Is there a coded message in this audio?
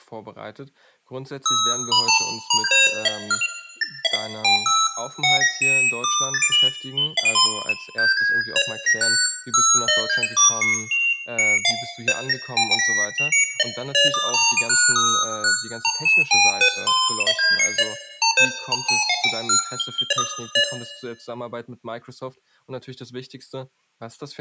No, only electronic bleeps of random pitch and length, with room echo and speech in German.